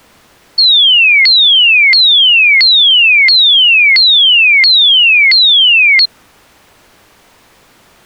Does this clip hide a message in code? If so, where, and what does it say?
No, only a tone that sweeps in pitch again and again.